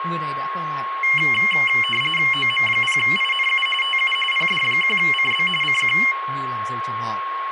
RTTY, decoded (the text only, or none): OM0INU TU PD1CB CQ